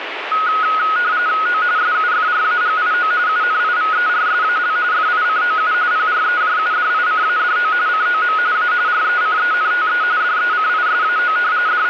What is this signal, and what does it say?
RTTY (45.45 baud, 170 Hz shift), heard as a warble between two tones, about 1360 Hz centre, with radio static. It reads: O SUFRAGIO UNIVERSAL FICOU PREJUDICADO COM A RECENTE DECISAO …